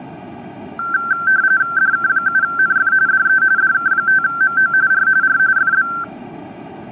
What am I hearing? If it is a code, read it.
RTTY (45.45 baud, 170 Hz shift), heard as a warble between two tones, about 1460 Hz centre. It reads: DK7NF DE DK5MO R R FB